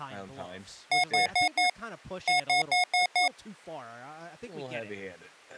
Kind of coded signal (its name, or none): beep code